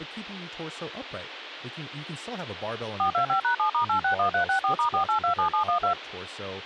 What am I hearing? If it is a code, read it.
DTMF, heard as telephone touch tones, dialled by machine, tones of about 100 ms, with radio hiss and speech in English. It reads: 425#7*861364*4827712